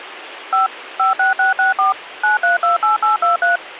DTMF, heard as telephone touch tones, dialled by machine, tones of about 140 ms, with radio hiss. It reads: 5 56664 9328823